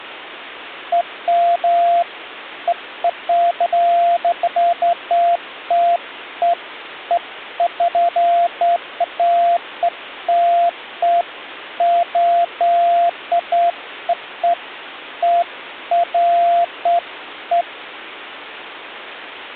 Beeps of irregular length. There is no code.